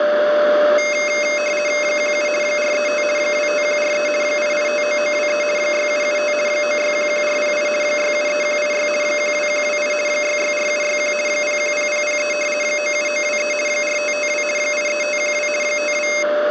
RTTY (50 baud, 450 Hz shift), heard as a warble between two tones, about 2350 Hz centre, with radio static and a steady whistle near 590 Hz. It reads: 17 435 25143 8859923 6775 9611408 673186 12128 664761 010003 97923 4552 83512 52